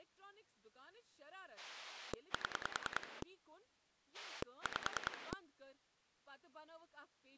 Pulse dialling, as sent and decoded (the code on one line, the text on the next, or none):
7 / 5
7 5